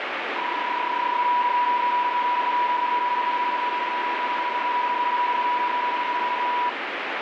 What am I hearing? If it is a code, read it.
PSK31 (31.25 baud), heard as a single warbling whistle, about 980 Hz, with radio static.